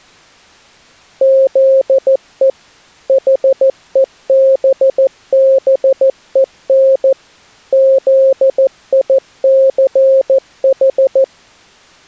Morse code, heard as a keyed tone, machine-sent, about 14 wpm, 540 Hz. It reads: ZE HEBBEN ZICH